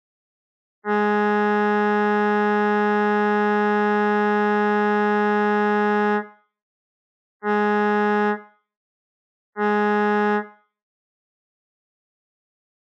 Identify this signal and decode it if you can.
Ship horn signal, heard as a ship's horn, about 210 Hz, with room echo. 1 long, 2 short. At sea: a vessel in fog that is sailing, fishing, towing or hampered.